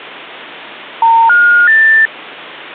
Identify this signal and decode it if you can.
Telephone call progress tone (North American plan), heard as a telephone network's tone, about 910, 1430, 1800 Hz. Special information tone.